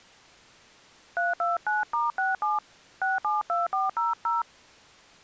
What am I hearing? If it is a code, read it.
DTMF, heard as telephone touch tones, dialled by hand, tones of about 170 ms. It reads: 329*67 672400